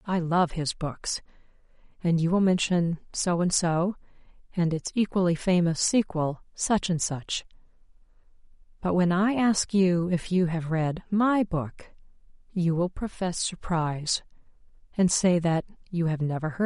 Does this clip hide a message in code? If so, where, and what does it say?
No, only speech in English.